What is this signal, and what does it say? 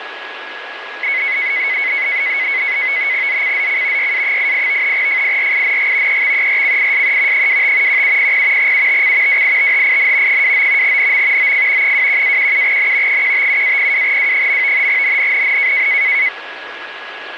NAVTEX (SITOR-B), 100 baud, 170 Hz shift, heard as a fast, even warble, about 2100 Hz centre, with radio static and a steady whistle near 1670 Hz. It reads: ZCZC YA88 FIRING EXERCISE 25 1700 UTC WITHIN 29 NM OF 21-17N 157-02W. NNNN